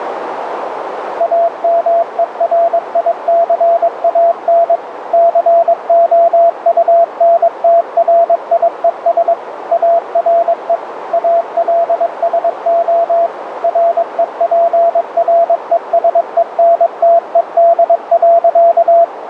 Morse code, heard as a keyed tone, machine-sent, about 22 wpm, 680 Hz, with radio static and a narrow filter. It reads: AMERICAN COUNTRIES ARE ALSO REPRESENTED.